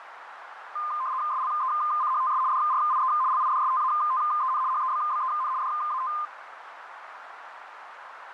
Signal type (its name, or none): RTTY